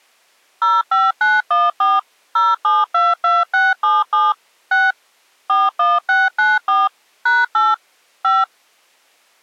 DTMF, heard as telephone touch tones, dialled by machine, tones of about 200 ms. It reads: 05914 0722677 6 41694 #8 5